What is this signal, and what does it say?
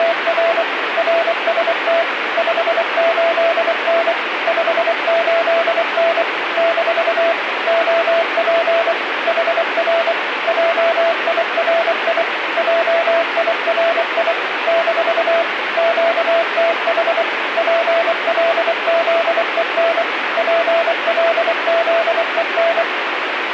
Morse code, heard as a keyed tone, machine-sent, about 24 wpm, 670 Hz, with radio static. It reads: … RST 58N 58N - OP HR JIRI JIRI - QTH PLZEN PLZEN